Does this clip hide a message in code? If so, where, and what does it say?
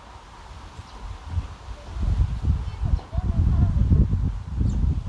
No, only the noise of a park.